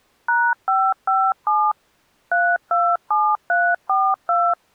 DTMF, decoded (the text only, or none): #557 327342